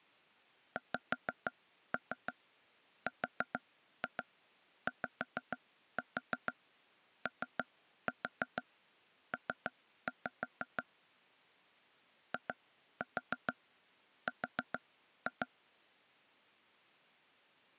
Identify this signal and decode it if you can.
Tap code, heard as taps on a table, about 6 knocks a second. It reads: XRYOP IR